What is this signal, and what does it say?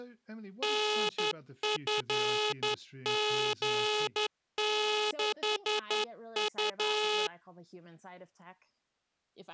Morse code, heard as a buzzer, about 11 wpm, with speech in English. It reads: NFG6U